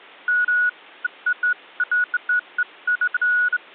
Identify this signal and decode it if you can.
Beeps of irregular length. There is no code.